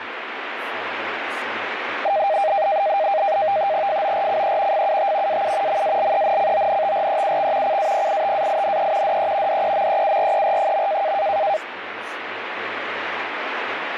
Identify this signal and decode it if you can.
NAVTEX (SITOR-B), 100 baud, 170 Hz shift, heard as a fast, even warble, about 710 Hz centre, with radio static. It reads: FORCE FUT AU MALENCONTREUX CAPITAINE DE DEMEURER.